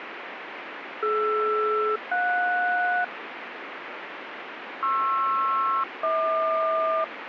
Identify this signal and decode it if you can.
Aircraft SELCAL, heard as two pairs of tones, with radio static. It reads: DR-JS PR-HQ